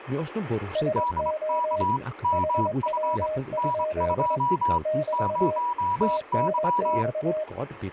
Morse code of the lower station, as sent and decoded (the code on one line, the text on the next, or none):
... --- / .... .-- ..--.. / -...- / - -. -..-
SO HW? <BT> TNX